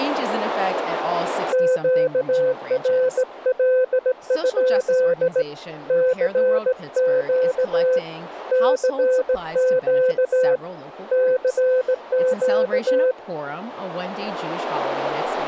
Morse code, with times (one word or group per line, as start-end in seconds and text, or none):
1.5-5.4 QRL?
5.9-8.0 CQ
8.5-10.6 CQ
11.1-13.1 CQ